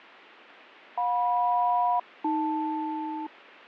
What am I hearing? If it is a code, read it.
Aircraft SELCAL, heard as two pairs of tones, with radio static and fading. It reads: JM-AL